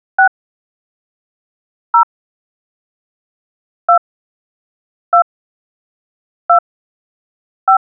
DTMF, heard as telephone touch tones, dialled by hand, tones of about 90 ms. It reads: 6 0 2 2 2 5